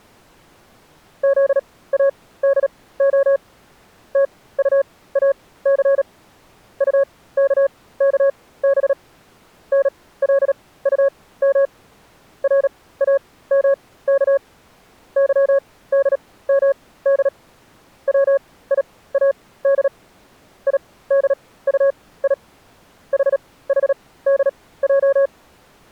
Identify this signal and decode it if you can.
Morse code, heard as a keyed tone, machine-sent, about 37 wpm, spaced as for 19 wpm, 550 Hz. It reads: ZADO TUAC UKKB NLUM RAMK YDMD WIAD IDUI HHDJ